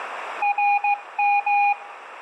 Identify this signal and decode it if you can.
Morse code (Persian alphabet), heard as a keyed tone, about 15 wpm, 820 Hz, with radio static and a narrow filter. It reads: رم